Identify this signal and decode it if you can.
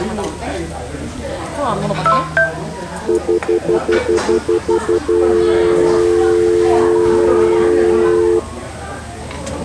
Telephone call progress tone (North American plan), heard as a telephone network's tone, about 350, 440 Hz, 0.1 s on and 0.1 s off, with the noise of a restaurant. Stutter dial tone.